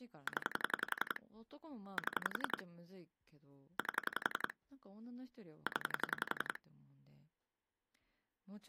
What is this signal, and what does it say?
Pulse dialling, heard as clicks on a phone line, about 11 pulses a second, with speech in Japanese. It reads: 0 7 8 0